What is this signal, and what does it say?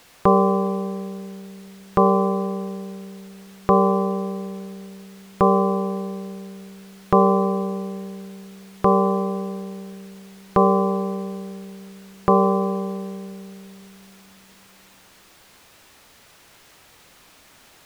Clock strike, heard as a bell. 8. Eight o'clock.